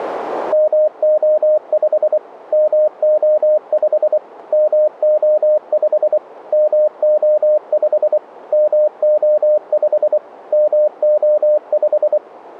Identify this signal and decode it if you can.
Morse code, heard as a keyed tone, machine-sent, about 24 wpm, 610 Hz. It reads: MO5 MO5 MO5 MO5 MO5 MO5